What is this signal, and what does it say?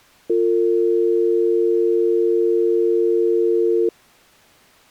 Telephone call progress tone (North American or UK plan), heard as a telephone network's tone, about 350, 450 Hz. Dial tone.